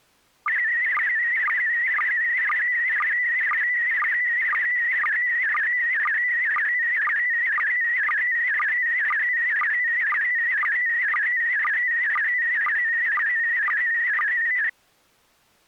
SSTV (slow-scan television), PD 120, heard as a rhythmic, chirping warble.